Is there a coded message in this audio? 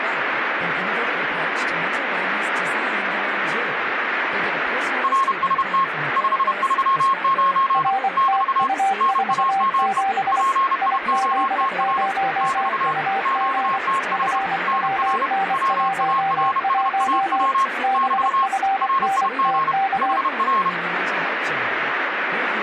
Yes: Morse code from 5.0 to 20.8 s, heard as two keyed tones, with radio static and speech in Swedish. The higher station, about 31 wpm, 1080 Hz: RST 539 <BT> NAME PIOTR <BT> QTH NR WARSAW <BT> RIG HR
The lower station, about 24 wpm, 780 Hz: RTU47 IZ0UG FWN11 BFNTK